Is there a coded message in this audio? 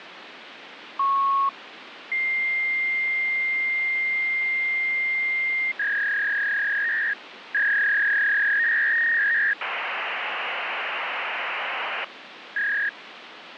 Yes: fax machine handshake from 1.0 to 12.9 s, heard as a beep, a long tone, a warble and hiss, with phone line noise.